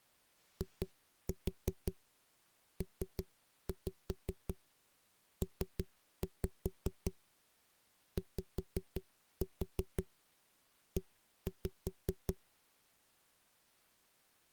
Tap code, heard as knocks on a wall, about 5 knocks a second. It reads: IPPYE